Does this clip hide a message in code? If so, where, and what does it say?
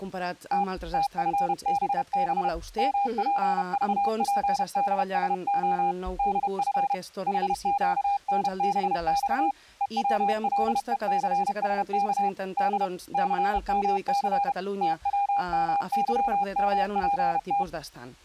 Yes: Morse code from 0.5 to 17.7 s, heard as a keyed tone, hand-sent with a paddle, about 31 wpm, 800 Hz. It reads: T TFBB MPVPDSO DF HQNBX EWLECSK D CMC TWMYMPT